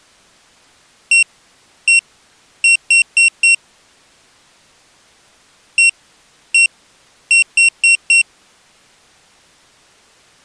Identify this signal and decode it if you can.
Beep code, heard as a piezo beeper, played twice, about 2750 Hz. 1-1-4. In Phoenix BIOS tables: BIOS ROM checksum failure.